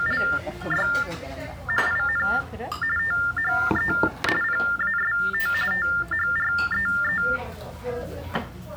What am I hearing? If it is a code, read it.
TTY/TDD text telephone tones (45.45 baud Baudot), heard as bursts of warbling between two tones, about 400 Hz shift, 1600 Hz centre, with the noise of a restaurant. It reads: … IN THE PAST THREE